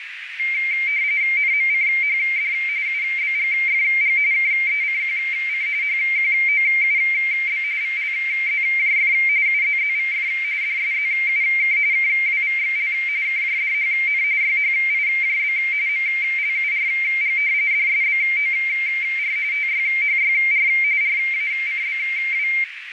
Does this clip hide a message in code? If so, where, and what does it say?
Yes: RTTY (45.45 baud, 170 Hz shift) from 0.4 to 22.6 s, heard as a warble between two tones, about 2200 Hz centre, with radio static and a narrow filter. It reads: NMCHD UBGFG KECQC HQOUB VLZJF UZZVF DSZUK KWVXL KJDHN YHIJB MLURG DSBOR TYHYR RACBW